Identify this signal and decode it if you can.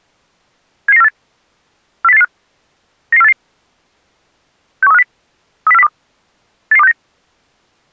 Five-tone selective call (EEA), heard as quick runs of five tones, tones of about 40 ms. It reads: 77948 40885 99488 61350 30402 88269